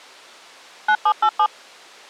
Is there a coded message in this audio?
Yes: DTMF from 0.9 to 1.5 s, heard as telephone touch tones, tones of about 70 ms. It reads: 9787